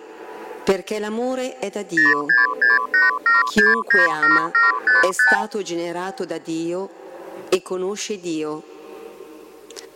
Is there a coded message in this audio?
Yes: multi-frequency trunk signalling (R2, with the far end's replies) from 2.0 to 5.4 s, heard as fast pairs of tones, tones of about 160 ms. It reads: 06687697755